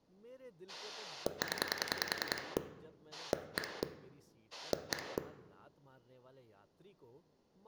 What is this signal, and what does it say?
Pulse dialling, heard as a rotary dial, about 10 pulses a second, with room echo and speech in Hindi. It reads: 0 1 1